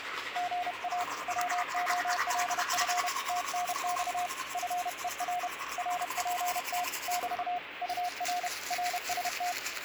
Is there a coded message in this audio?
Yes: Morse code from 0.3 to 9.6 s, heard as a keyed tone, hand-sent with a paddle, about 31 wpm, 720 Hz, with radio static and the noise of a restroom. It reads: GA WOLF TNX FER RPT <BT> UR RST